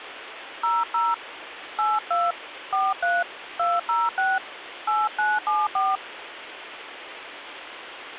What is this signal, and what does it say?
DTMF, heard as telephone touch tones, dialled by hand, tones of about 200 ms, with phone line noise. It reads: 00 82 43 206 8974